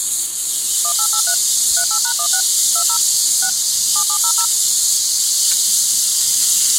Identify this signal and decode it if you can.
DTMF, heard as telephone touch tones, dialled by machine, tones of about 80 ms. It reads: 1883 38#16 20 6 7700